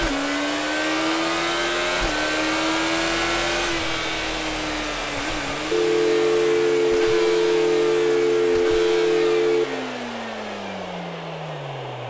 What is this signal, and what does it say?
Telephone call progress tone (North American or UK plan), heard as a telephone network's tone, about 350, 440 Hz, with phone line noise and room echo. Dial tone.